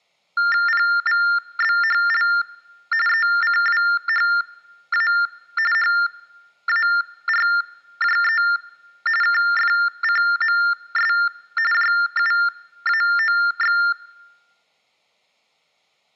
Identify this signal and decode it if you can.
TTY/TDD text telephone tones (45.45 baud Baudot), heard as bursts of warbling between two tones, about 400 Hz shift, 1600 Hz centre. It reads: PVBHL ECWHA HARJE KFCMS JUAOX